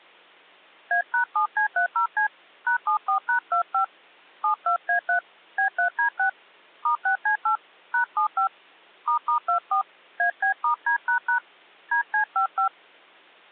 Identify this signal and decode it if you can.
DTMF, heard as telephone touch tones, dialled by hand, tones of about 100 ms. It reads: A#7C30C #74#25 72A3 B3D6 *6C8 #75 **24 AB*D## DC55